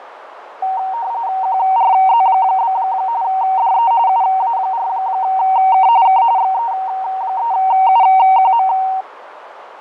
RTTY (45.45 baud, 170 Hz shift), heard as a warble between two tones, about 840 Hz centre, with radio static, fading and a narrow filter. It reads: QRZ? DE UA4K K XE3UQM